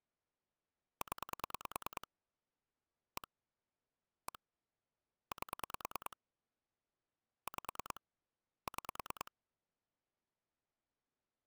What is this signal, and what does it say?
Pulse dialling, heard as clicks on a phone line, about 9 pulses a second. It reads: 0 1 1 8 5 6